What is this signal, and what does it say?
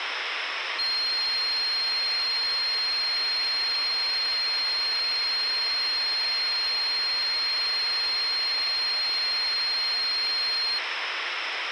A steady tone, with radio hiss. There is no code.